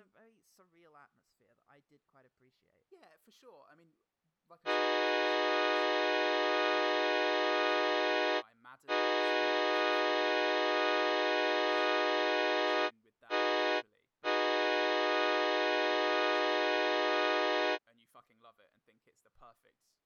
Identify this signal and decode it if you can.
Train horn signal, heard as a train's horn, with speech in English. 2 long, 1 short, 1 long. On North American railways: approaching a public crossing.